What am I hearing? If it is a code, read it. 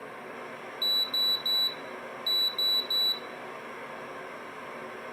Beep code, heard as a piezo beeper, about 3950 Hz, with room echo. 3-3.